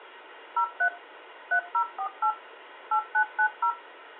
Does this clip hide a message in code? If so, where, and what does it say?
Yes: DTMF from 0.6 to 3.7 s, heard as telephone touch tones, dialled by machine, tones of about 80 ms, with phone line noise. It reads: 03 3048 8990